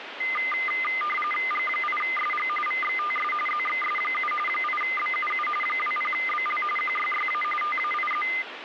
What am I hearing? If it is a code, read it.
RTTY (45.45 baud, 850 Hz shift), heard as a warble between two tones, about 1650 Hz centre, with radio static. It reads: G8SG VXTS ZXS7 8BUU 20BL QYYA TAIZ